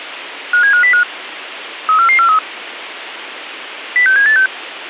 Five-tone selective call (CCIR), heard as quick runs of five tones, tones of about 100 ms, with radio hiss. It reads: 57505 34443 06786